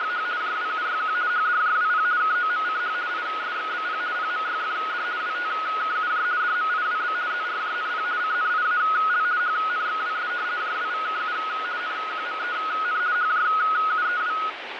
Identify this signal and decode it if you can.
RTTY (50 baud, 170 Hz shift), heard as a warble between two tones, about 1360 Hz centre, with radio static. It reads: … JWUYQ HDJWP KOMCH ISXBP PMYFD WTKUJ DMIWB ZRJNP CNIAL HNXWS JWVKU NQMEN HJUEW